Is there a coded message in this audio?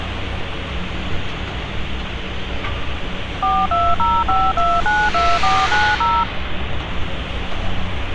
Yes: DTMF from 3.4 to 6.2 s, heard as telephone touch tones, dialled by machine, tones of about 230 ms, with phone line noise and street noise. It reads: 4205292490